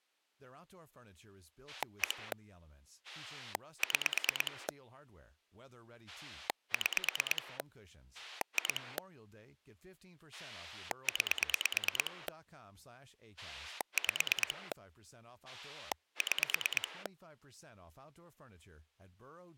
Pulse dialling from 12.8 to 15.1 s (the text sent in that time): 5